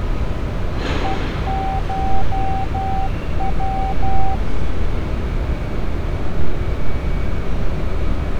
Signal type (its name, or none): Morse code